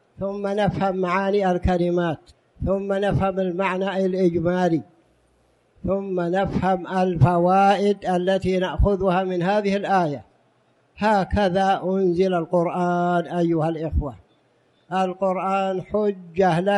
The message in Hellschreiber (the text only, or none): none